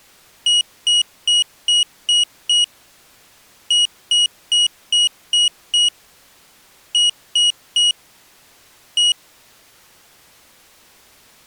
Beep code, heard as a piezo beeper, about 2900 Hz. 6-6-3-1.